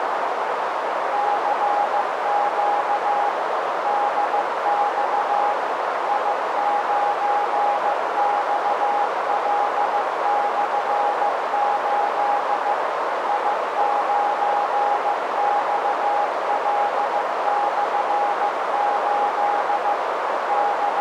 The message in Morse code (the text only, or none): CQ DX I9XL/8 I9XL/8 …